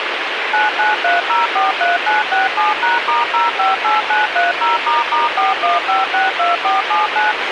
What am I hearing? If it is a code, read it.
DTMF, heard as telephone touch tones, dialled by machine, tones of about 160 ms, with radio hiss and a squelch burst at the end. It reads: 993043967#*058930**41562479